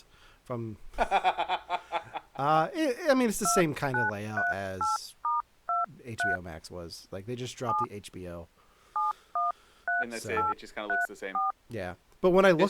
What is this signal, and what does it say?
DTMF, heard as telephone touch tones, dialled by hand, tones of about 160 ms, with speech in English. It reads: 2938*23 7 713834